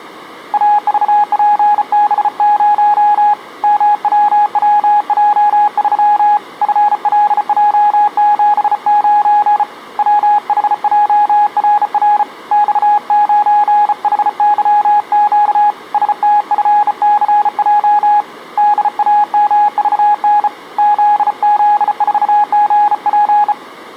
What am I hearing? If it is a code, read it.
Morse code, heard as a keyed tone, hand-sent with a bug key, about 34 wpm, 830 Hz. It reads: AVPB0 MWWJ3 FLJ79 WHJRR X9HYQ STFCJ DAMVN ZZ4GP